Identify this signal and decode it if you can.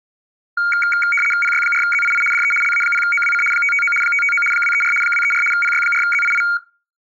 RTTY (75 baud, 850 Hz shift), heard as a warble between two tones, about 1850 Hz centre. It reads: PY4ZII DE LA0OWC 559 559 234 234 PY4ZII